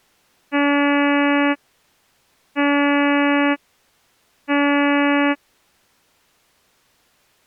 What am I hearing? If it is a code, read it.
Ship horn signal, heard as a ship's horn, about 290 Hz. 3 short. At sea: I am operating astern propulsion.